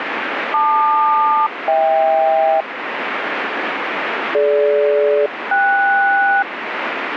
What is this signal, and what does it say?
Aircraft SELCAL, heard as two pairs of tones, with radio static. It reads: LQ-HK DG-KS